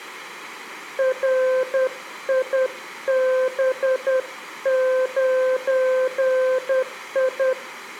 Morse code, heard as a keyed tone, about 10 wpm, 520 Hz, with room echo. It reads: RIB9I